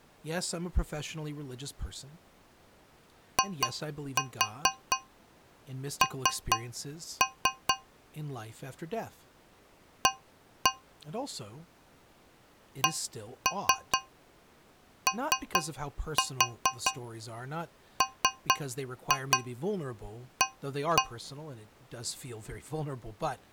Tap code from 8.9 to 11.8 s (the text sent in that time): A